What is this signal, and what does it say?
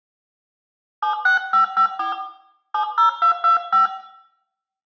DTMF, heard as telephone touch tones, dialled by hand, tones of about 110 ms, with room echo. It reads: 76554 70225